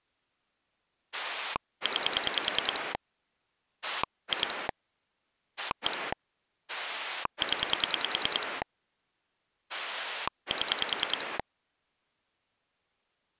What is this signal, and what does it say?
Pulse dialling, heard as a rotary dial, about 10 pulses a second. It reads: 9 2 1 0 7